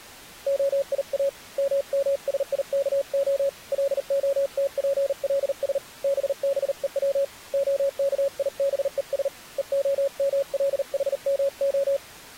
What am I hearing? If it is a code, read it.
Morse code (Hebrew alphabet), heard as a keyed tone, hand-sent with a paddle, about 39 wpm, 550 Hz. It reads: היא ממשיכה להתפלש בבוץ הכיבוש והמלחמה